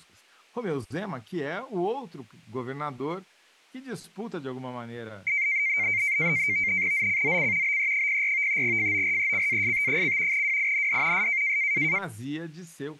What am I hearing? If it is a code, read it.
NAVTEX (SITOR-B), 100 baud, 170 Hz shift, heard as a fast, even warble, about 2200 Hz centre, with speech in Portuguese. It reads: ZCZC BE04 FORECAST: WIND S